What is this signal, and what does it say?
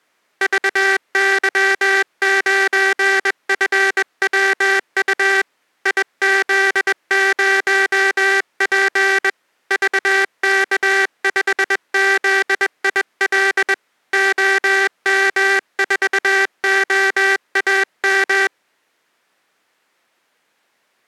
Morse code, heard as a buzzer, hand-sent with a bug key, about 21 wpm. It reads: VY9FWU IZ0P VK5ZIL OM4OAM